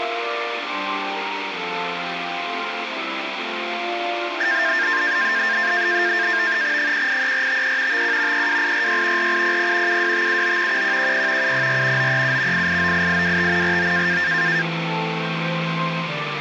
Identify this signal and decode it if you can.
NAVTEX (SITOR-B), 100 baud, 170 Hz shift, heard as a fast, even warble, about 1700 Hz centre, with radio static. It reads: 183453 51 32846 4800 72579 1110 704 937 8898825 49